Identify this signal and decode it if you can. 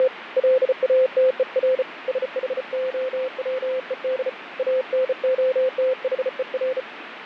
Morse code, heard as a keyed tone, hand-sent with a bug key, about 34 wpm, 520 Hz, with radio static and fading. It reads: … LATER SHOWED ANOTHER